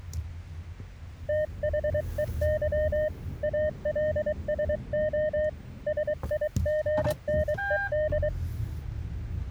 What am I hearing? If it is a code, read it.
Morse code, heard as a keyed tone, hand-sent with a paddle, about 23 wpm, 610 Hz, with the noise inside a car. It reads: THEY ALSO SIGNED